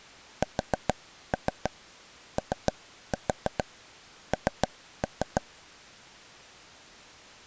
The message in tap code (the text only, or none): SON